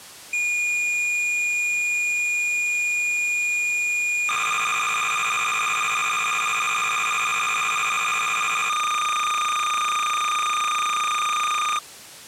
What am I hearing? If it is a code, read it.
Cassette data (Kansas City type), 300 baud, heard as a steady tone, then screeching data.